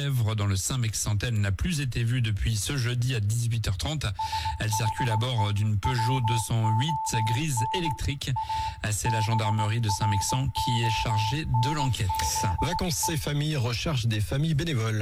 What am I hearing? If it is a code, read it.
Morse code, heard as a keyed tone, hand-sent with a straight key, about 19 wpm, 880 Hz, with room echo. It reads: SHE WON A BRONZE